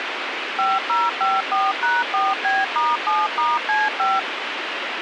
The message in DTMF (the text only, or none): 5054#4B*7*C5